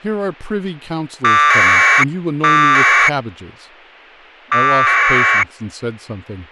Packet radio (AX.25, as in APRS), 1200 baud, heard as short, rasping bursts, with speech in English.